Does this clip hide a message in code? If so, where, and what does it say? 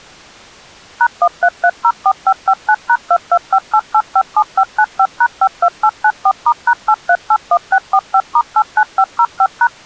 Yes: DTMF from 1.0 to 9.7 s, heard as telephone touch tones, dialled by machine, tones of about 60 ms. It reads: #13304559#2258857595#52894*#8381645*89505#